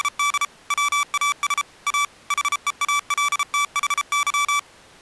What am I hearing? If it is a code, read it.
Morse code, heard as electronic beeps, machine-sent, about 33 wpm, 1160 Hz. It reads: … WAS A HEALTHY